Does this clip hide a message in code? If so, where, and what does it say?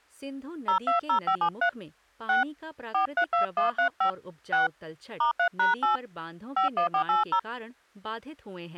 Yes: DTMF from 0.7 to 7.4 s, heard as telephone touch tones, dialled by hand, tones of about 110 ms, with speech in Hindi. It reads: 020573 6 432135 6 *3#8 51480